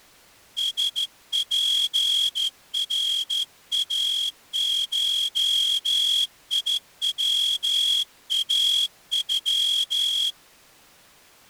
Morse code (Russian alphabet), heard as a whistle, hand-sent with a straight key, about 13 wpm. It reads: СПРАШИВАЮ